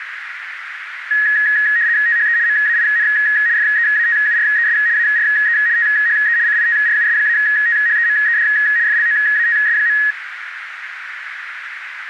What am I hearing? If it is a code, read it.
RTTY (75 baud, 170 Hz shift), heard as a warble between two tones, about 1800 Hz centre, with radio static and a narrow filter. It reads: THE MAIN FEATURES ARE THE CITRUS-THEMED FLOATS.